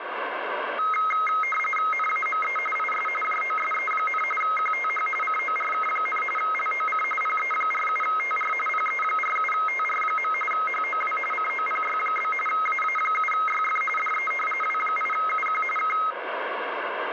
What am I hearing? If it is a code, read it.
RTTY (45.45 baud, 850 Hz shift), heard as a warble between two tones, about 1700 Hz centre, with radio static. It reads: NAME IS JOSE, QTH CORK, LOC PE47TR PE47TR. HOW COPY? AA7YF DE W8UQ K